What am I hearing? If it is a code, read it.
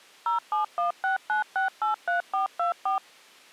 DTMF, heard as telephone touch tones, dialled by machine, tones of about 130 ms. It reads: 07169683424